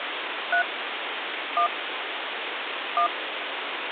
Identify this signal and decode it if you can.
DTMF, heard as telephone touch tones, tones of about 100 ms, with phone line noise. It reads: 3 1 1